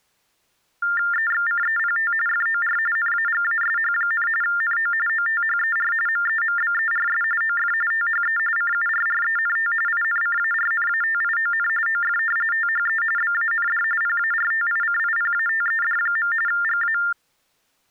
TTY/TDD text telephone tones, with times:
1.1-2.1 EXCEPT
2.3-2.8 FOR
3.0-4.3 NAGASH,
4.4-4.9 NO
5.1-5.9 OTHER
6.1-7.2 MEMBERS
7.4-7.7 OF
7.9-8.4 THE
8.6-9.7 CURRENT
9.9-11.7 INCARNATION
11.9-12.2 OF
12.5-13.0 THE
13.2-13.8 BAND
14.0-16.3 PARTICIPATED.
16.5-17.0 GA

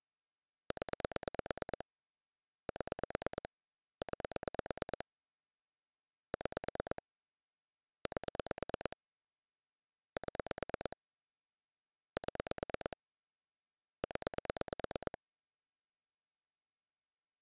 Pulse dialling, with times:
0.7-1.9 0
2.7-3.5 7
4.0-5.1 9
6.3-7.0 6
8.1-9.0 8
10.2-11.0 7
12.2-13.0 7
14.0-15.2 0

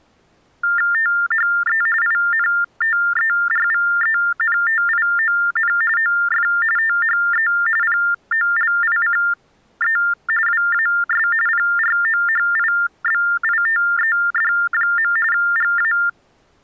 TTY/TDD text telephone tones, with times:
0.9-1.8 THE
2.0-5.7 INTERVENTION
6.0-6.5 OF
6.8-7.5 THE
7.8-10.0 POLICE
10.5-11.3 WAS
11.5-15.1 PROHIBITED.
15.3-15.9 GA

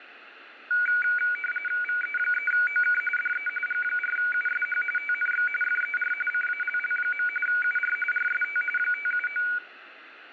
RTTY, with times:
1.8-3.0 VE3OK
3.2-3.5 DE
3.7-4.8 G4USH
5.0-5.5 TNX
5.6-6.1 FER
6.3-7.3 CALL.
7.5-8.0 UR
8.1-8.6 RST
8.8-9.4 579

